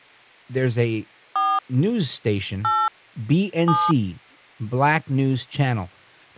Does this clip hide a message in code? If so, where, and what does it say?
Yes: DTMF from 1.4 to 3.9 s, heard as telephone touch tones, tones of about 230 ms, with speech in English. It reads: 4 8 7